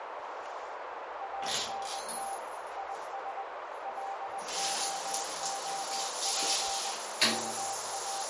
Morse code, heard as a keyed tone, machine-sent, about 20 wpm, 790 Hz, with heavy radio static, a narrow filter and the noise of a restroom. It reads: ANT IS LOOP …